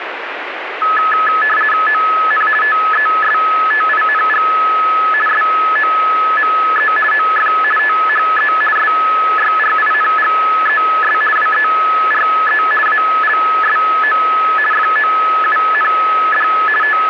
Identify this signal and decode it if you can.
RTTY (50 baud, 450 Hz shift), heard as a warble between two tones, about 1500 Hz centre, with radio static. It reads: ON TESTING SOME OF THE SYRINGES WERE ALSO FOUND …